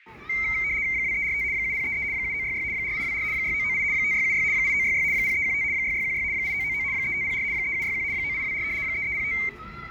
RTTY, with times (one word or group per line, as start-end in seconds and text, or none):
0.9-1.4 2345
1.5-2.0 7033
2.1-2.6 7966
2.7-3.2 4824
3.3-3.8 6998
3.9-4.4 5676
4.5-5.0 8966
5.1-5.6 0315
5.7-6.2 6616
6.3-6.8 8999
6.9-7.4 3504
7.5-8.0 3761
8.1-8.6 9824
8.8-9.3 3305